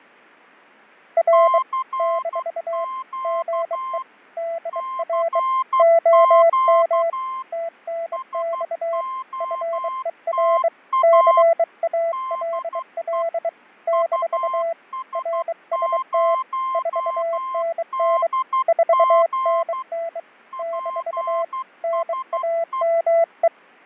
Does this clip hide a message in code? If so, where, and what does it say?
Yes: Morse code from 1.1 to 23.5 s, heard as two keyed tones, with fading. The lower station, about 23 wpm, 670 Hz: R - GE DR OM TNX FER CALL - RST 4NN 4NN - NAME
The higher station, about 12 wpm, 1050 Hz: CQ CQ SOTA DE US0DG PSE